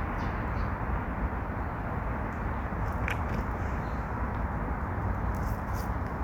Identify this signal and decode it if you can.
Street noise. There is no code.